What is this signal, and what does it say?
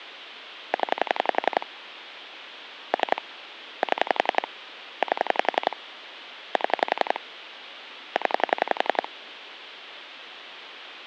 Pulse dialling, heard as clicks on a phone line, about 11 pulses a second. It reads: 0 3 7 8 7 0